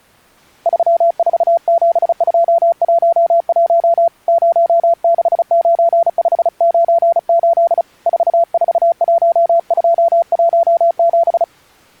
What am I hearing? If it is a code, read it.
Morse code, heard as a keyed tone, hand-sent with a paddle, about 35 wpm, 680 Hz. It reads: 347211 069598 441217